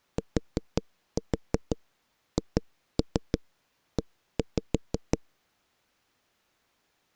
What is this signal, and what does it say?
Tap code, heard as knocks on a wall, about 6 knocks a second. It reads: THE